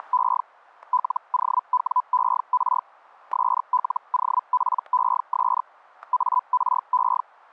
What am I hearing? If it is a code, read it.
Hellschreiber (Feld-Hell, 122.5 baud), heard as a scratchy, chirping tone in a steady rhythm, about 1000 Hz, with static crashes. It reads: … LOWER SLOPES ARE